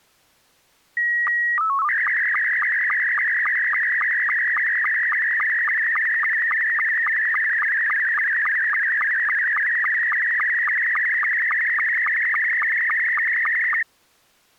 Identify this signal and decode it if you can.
SSTV (slow-scan television), Scottie S2, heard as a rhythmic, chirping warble.